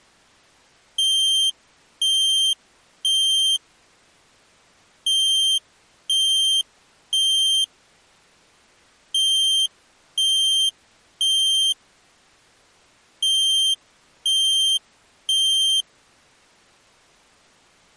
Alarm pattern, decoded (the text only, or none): temporal three